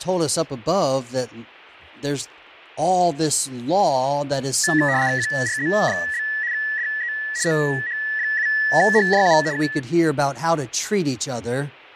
RTTY (75 baud, 170 Hz shift), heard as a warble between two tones, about 1800 Hz centre, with fading and speech in English. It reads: QRZ? DE OH7HJU K